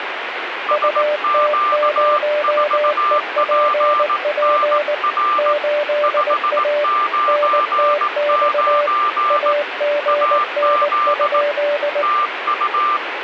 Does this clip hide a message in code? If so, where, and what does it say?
Yes: Morse code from 0.6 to 13.0 s, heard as two keyed tones, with radio static. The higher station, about 18 wpm, 1190 Hz: SQ4PNR 599 AZ TU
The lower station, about 19 wpm, 590 Hz: UT0EPP 8A NTX AGN?